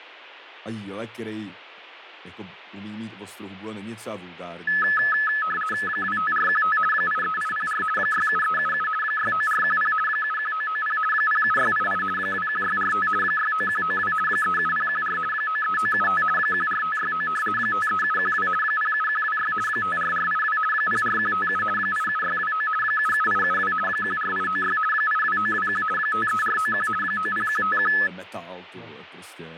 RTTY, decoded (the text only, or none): 25415 83804 67377 69410 71990 07688 21645 69192 37014 93975 14569 53712 07126 54482 04157 87629 77872 14896 82921 53491 90151